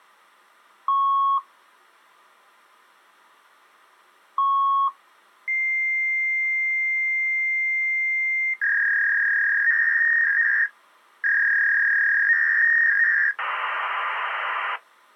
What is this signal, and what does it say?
Fax machine handshake, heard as beeps, a long tone, a warble and hiss.